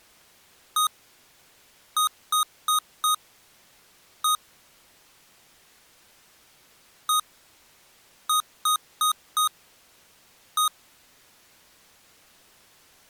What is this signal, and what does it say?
Beep code, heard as beeps from a small speaker, played twice, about 1240 Hz. 1-4-1. In Phoenix BIOS tables: address line failure in the first 64 KB of memory.